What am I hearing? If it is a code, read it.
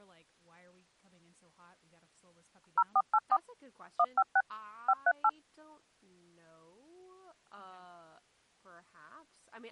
DTMF, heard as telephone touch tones, dialled by machine, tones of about 50 ms, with speech in English. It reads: 0484 156 538